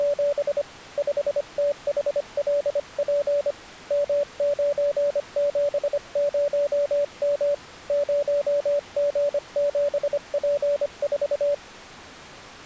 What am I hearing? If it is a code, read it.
Morse code, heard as a keyed tone, hand-sent with a paddle, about 25 wpm, 580 Hz. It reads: … 5THLP M970M 0G7P4